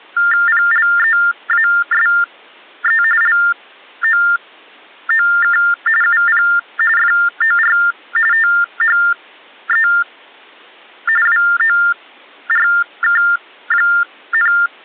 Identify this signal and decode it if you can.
TTY/TDD text telephone tones (45.45 baud Baudot), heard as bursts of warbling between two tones, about 400 Hz shift, 1600 Hz centre. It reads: PLEASE LOOK UP FOR THE WORK,